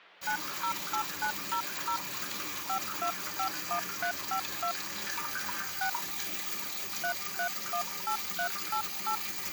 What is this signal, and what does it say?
DTMF, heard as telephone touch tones, dialled by hand, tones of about 90 ms, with hum and the noise of a restroom. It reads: 908900 5251352 6 3318388